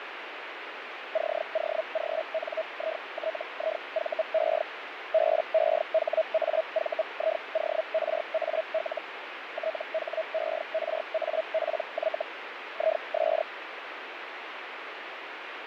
Hellschreiber (Feld-Hell, 122.5 baud), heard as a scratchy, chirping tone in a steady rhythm, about 640 Hz, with radio static and fading. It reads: COGNITIVE BEHAVIORAL THERAPY IS